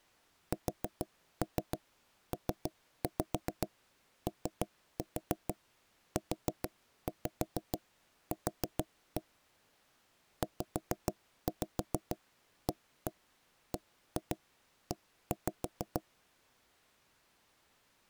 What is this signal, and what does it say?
Tap code, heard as knocks on wood, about 6 knocks a second. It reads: SPOUQ ZABE